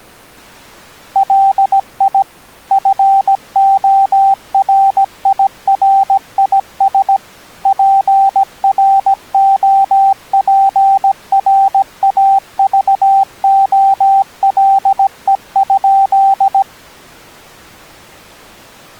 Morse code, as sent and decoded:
.-.. .. / ..-. --- .-. .. .-. .. ... / .--. .-. --- .--. .-. .- ...- --- .-.. . ..--..
LI FORIRIS PROPRAVOLE?

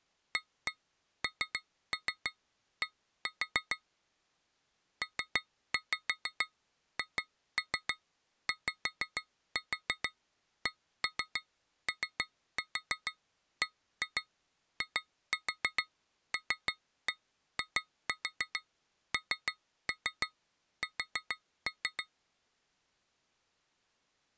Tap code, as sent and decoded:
1-1 3-3 1-4 / 3-5 2-3 5-4 1-3 3-4 1-2 2-4 3-1 2-4 3-3 4-3
AND PHYCOBILINS

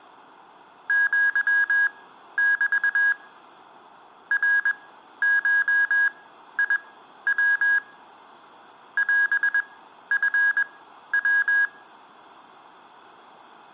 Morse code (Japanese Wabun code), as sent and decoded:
--.-- -...- / .-. ---- .. .-- / .-... ..-. .--
アメ ナゴヤ オチヤ

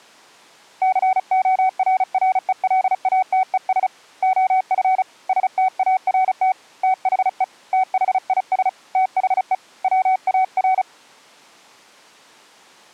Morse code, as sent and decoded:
-.-. --- .-. .-. . .-.. .- - . ... / --- ..-. / ... - .- .-. - / - .... . / - .... .. ... / - .... . / .-- .- .-.
CORRELATES OF START THE THIS THE WAR

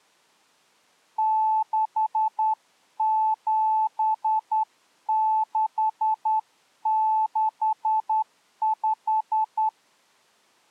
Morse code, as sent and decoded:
-.... --... -.... -.... .....
67665

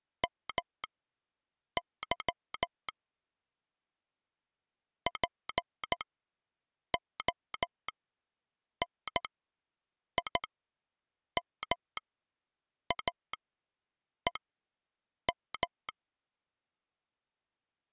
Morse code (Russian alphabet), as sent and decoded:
-- -.-- / .--. --- -. .. -- .- . --
МЫ ПОНИМАЕМ

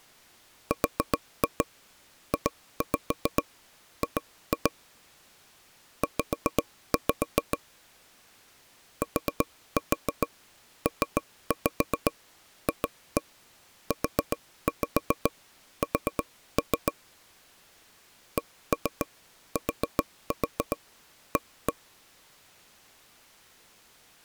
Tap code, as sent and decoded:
4-2 2-5 2-2 / 5-5 / 4-4 3-5 2-1 4-5 4-3 / 1-3 4-4 1-1
RJG Z TPFUS CTA

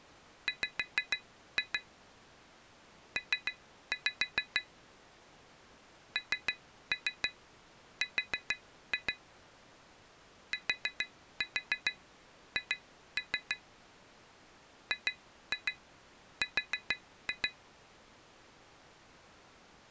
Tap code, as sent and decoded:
5-2 / 3-5 / 3-3 4-2 / 4-4 2-3 / 2-2 4-2
W P NR TH GR

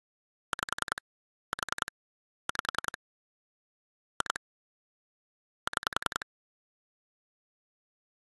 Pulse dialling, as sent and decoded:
5 / 4 / 5 / 2 / 6
5 4 5 2 6

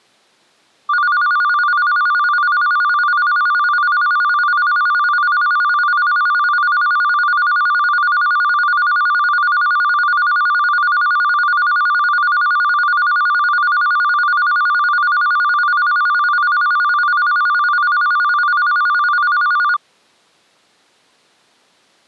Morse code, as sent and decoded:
none

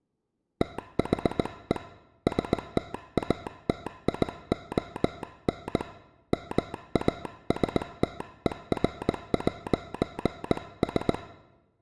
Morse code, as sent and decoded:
- .... . / ... - .- - .. --- -. / -- .- ... - . .-. .----. ...
THE STATION MASTER'S

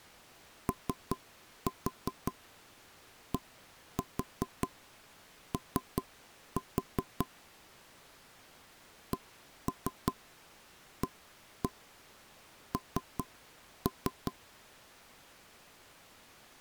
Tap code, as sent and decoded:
3-4 1-4 3-4 / 1-3 1-1 3-3
ODO CAN

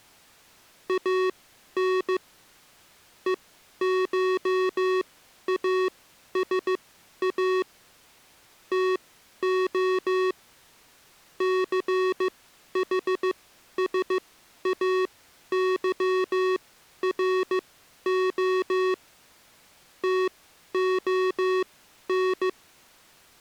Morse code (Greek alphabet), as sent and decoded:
.- -. / . ---- .- ... .- / - --- / -.-. .... ... .- -.-- .-. --- / - --- -.
ΑΝ ΕΧΑΣΑ ΤΟ ΘΗΣΑΥΡΟ ΤΟΝ

